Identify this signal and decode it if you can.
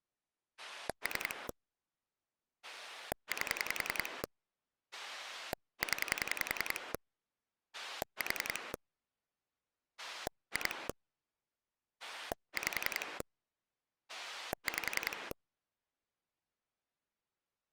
Pulse dialling, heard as a rotary dial, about 10 pulses a second. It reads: 3 8 0 4 2 5 5